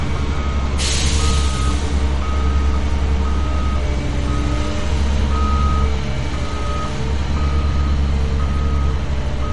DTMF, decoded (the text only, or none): none